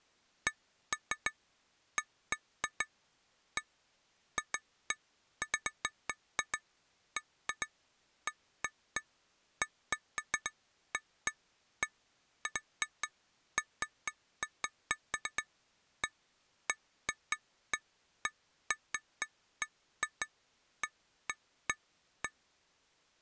Irregular taps on glass. There is no code.